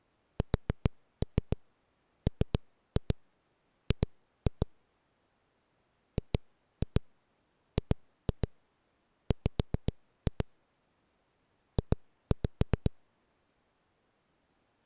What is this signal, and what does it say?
Tap code, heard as knocks on a wall, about 7 knocks a second. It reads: SMG GGW J